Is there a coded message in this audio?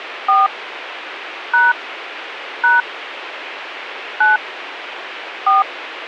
Yes: DTMF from 0.3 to 5.6 s, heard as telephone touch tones, dialled by hand, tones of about 190 ms, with radio hiss. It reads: 4 # # 9 4